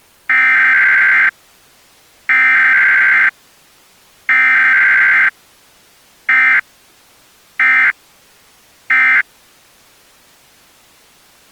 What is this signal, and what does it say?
Emergency Alert System (SAME) tones (header bursts, then end-of-message bursts), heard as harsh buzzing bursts, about 520.83 baud.